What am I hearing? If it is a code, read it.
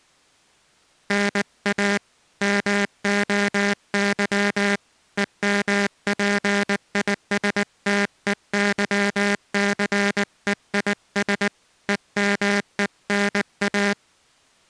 Morse code (Greek alphabet), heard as a buzzer, hand-sent with a paddle, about 19 wpm. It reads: ΝΑ ΜΟΥ ΕΜΠΙΣΤΕΥΘΕΙΣ ΕΜΕΝΑ